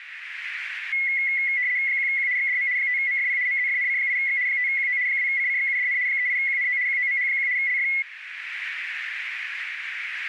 RTTY (75 baud, 170 Hz shift), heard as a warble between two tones, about 2050 Hz centre, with radio static. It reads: 1Q XDM 5MFP MZFNC8X 5QO 2CCXUDN 38QNO QOMH1 LF